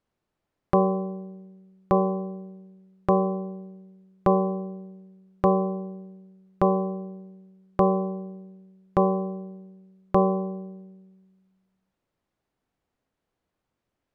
Clock strike, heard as a bell. 9. Nine o'clock.